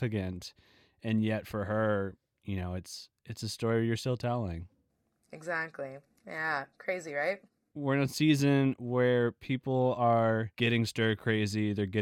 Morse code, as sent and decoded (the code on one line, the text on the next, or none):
none